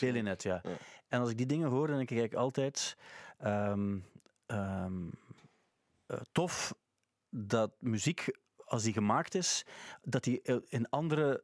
Speech in Dutch. There is no code.